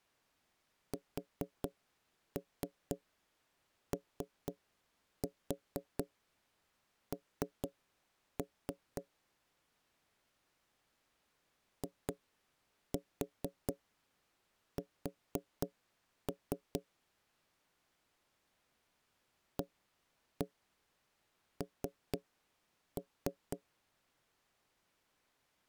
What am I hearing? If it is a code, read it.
Tap code, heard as knocks on wood, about 4 knocks a second. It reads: SON IS AN